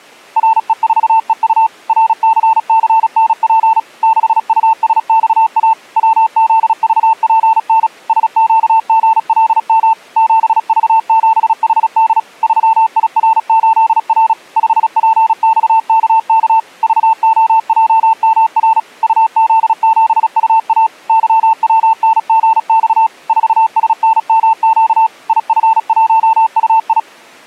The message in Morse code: RE4EU RCCNP 6USXA WZVPN SQGLM 7V7HD 3IR8R 5PXKK VOJMR UZ7UA YWNGX 4SNMQ IF1UI

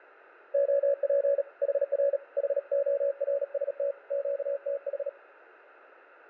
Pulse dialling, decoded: none

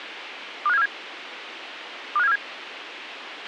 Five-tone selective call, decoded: 25747 25747

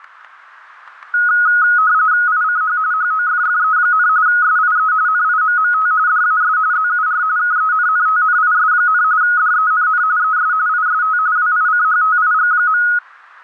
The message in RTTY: ICH HOFFE, SIE NIMMT DAS ZUR KENNTNIS, DENN ES IST WICHTIG.

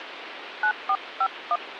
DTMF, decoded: 9451

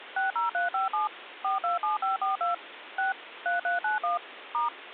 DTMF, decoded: 60357 427542 6 3391 *

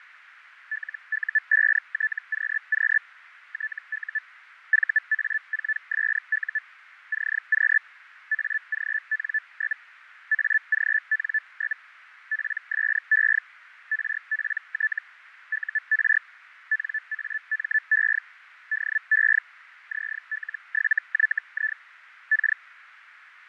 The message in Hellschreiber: LU5TQQ TU VA4SU CQ AGN? AGN? PSE RPT UR NAME DE ZL7YI K

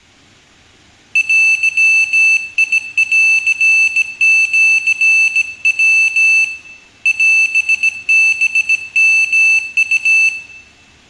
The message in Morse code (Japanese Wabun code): デンシヤ オハヨウ

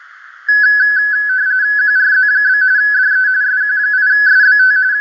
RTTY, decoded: QRZ? DE SQ8SBT …

